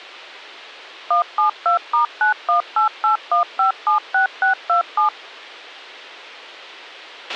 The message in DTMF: 172*91881576627

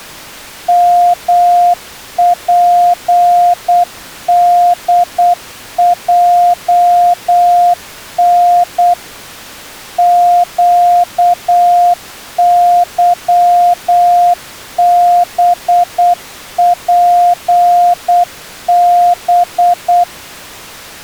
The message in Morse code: MPDJN QYBPB

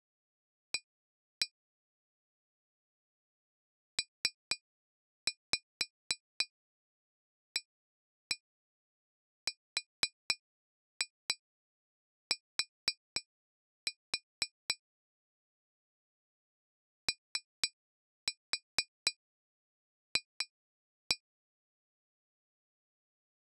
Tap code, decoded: A PART OF

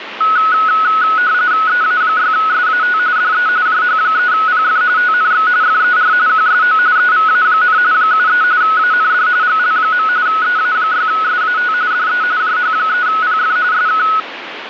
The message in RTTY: EA6SAT DE JH3PF TNX FER QSO EVA, 73 AND GL. EA6SAT DE JH3PF SK

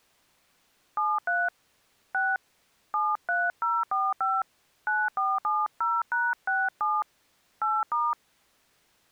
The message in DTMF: 73 6 73045 9470#67 8*

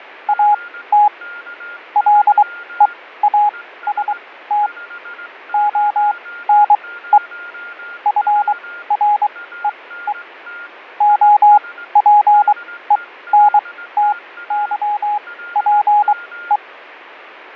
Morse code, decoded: AT LEAST ONE FREE OPENTYPE

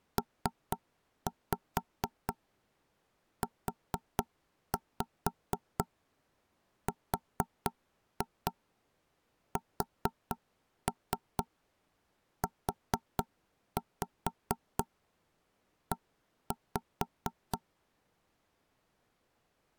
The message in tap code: PURSUE

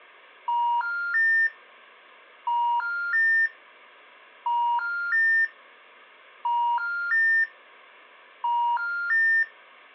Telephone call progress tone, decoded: special information tone

